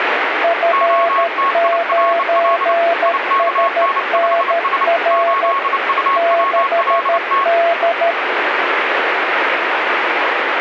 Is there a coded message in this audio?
Yes: Morse code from 0.4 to 8.2 s, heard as two keyed tones, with radio static. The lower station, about 13 wpm, 680 Hz: F9SNR 6D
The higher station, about 29 wpm, 1100 Hz: OTIRL IKN5S 8UWLT